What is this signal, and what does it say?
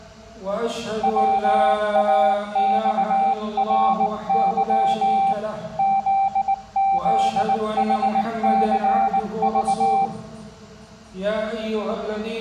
Morse code, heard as a keyed tone, hand-sent with a bug key, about 19 wpm, 780 Hz. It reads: WAXRY ZZHCV